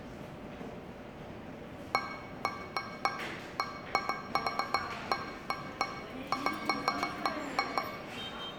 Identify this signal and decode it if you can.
Irregular taps on a metal pipe, with room echo and the noise of a subway station. There is no code.